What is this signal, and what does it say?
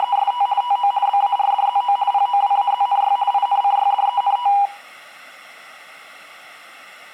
RTTY (50 baud, 170 Hz shift), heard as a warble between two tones, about 890 Hz centre. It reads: … TO BARDZO POWAZNY INCYDENT